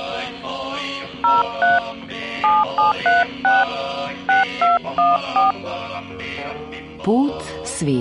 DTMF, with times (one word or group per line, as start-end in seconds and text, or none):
1.2-1.8 03
2.4-3.6 7736
4.3-5.5 6214